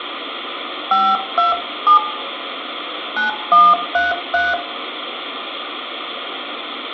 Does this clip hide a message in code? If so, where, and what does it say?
Yes: DTMF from 0.9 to 4.5 s, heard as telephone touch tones, dialled by hand, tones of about 190 ms, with phone line noise and room echo. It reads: 527 9133